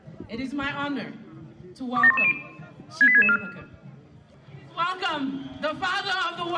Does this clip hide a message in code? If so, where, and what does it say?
Yes: five-tone selective call (ZVEI) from 2.0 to 3.4 s, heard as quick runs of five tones, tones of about 70 ms. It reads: 27110 68664